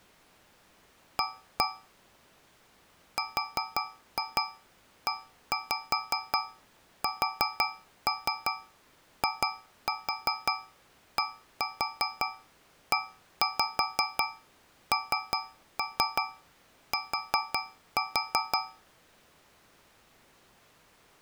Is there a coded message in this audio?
Yes: tap code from 1.2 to 18.9 s, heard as taps on a metal pipe, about 5 knocks a second. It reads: A RESIDENT